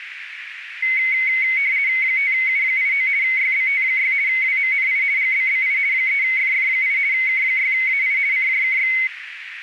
RTTY (50 baud, 170 Hz shift), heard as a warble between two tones, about 2150 Hz centre, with radio static and a narrow filter. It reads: 5U89 YBT6 WMNI GBBI 3FF8 K6AI CJKX